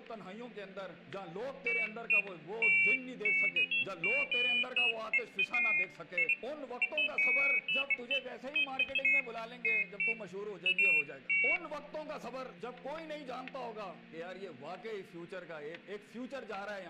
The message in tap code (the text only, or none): none